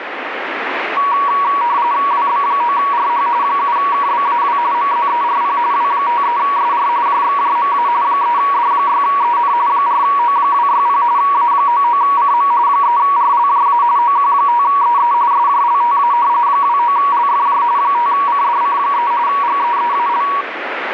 RTTY (45.45 baud, 170 Hz shift), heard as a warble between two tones, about 1040 Hz centre, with radio static. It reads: WB9RH 7KBAW MZERP W53SR JXJMA 3D6EN 4O260 A99CM 3RLJA OQ5EE SJLTA 29LFJ 5CDC3 GEEAL